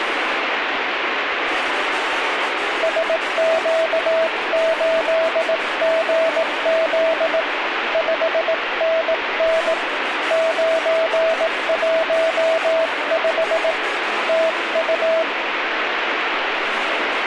Morse code, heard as a keyed tone, hand-sent with a paddle, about 18 wpm, 650 Hz, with radio static. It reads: SQ8GZ 5NN 915 TU